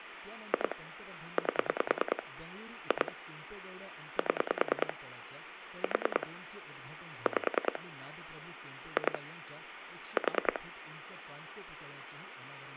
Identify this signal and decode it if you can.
Pulse dialling, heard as clicks on a phone line, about 10 pulses a second, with phone line noise and speech in Marathi. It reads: 2 8 2 7 4 5 2 4